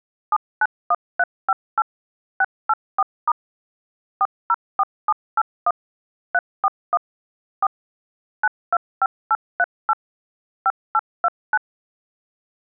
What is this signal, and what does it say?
DTMF, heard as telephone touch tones, dialled by machine, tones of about 40 ms. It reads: 791358 684* 404781 341 4 925838 5829